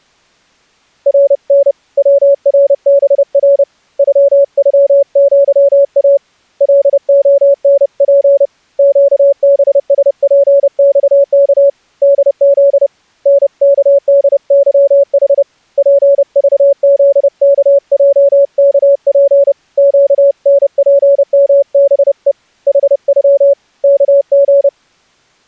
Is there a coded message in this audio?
Yes: Morse code (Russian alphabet) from 1.0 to 24.7 s, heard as a keyed tone, hand-sent with a paddle, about 30 wpm, 560 Hz. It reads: РН ВРБР ЮЮЪА ЛОНП ЩБСПЬК ДЗ НКДЫХ ПЖЗКЙКП ЩНПМБЕ ХЮ КГ